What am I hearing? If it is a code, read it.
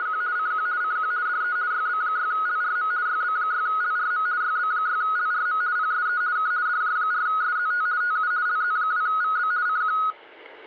RTTY (50 baud, 170 Hz shift), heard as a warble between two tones, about 1360 Hz centre, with radio static. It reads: … CQ CQ DE YB6LRM YB6LRM YB6LRM PSE K DJ4SZT TU LZ2VB CQ